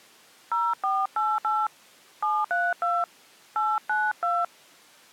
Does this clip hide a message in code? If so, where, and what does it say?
Yes: DTMF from 0.5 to 4.4 s, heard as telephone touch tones, dialled by hand, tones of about 220 ms. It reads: 0488 732 892